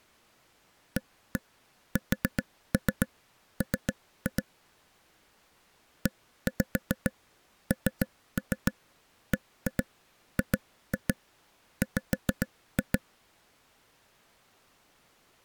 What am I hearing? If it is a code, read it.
Tap code, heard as taps on a table, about 7 knocks a second. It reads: ASM ENBGW